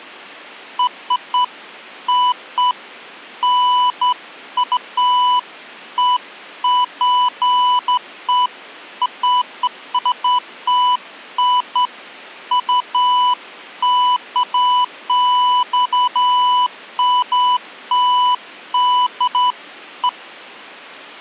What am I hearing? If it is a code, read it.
Beeps of irregular length. There is no code.